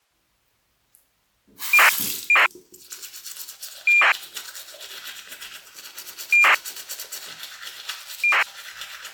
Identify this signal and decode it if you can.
ACARS aircraft data, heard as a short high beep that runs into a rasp, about 2400 baud, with the noise of a restroom.